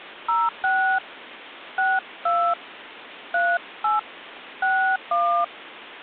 DTMF, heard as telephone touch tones, dialled by hand, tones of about 250 ms. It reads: 06 62 38 61